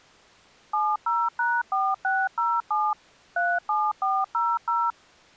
DTMF, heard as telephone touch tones, dialled by machine, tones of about 230 ms. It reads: 70#4607 37400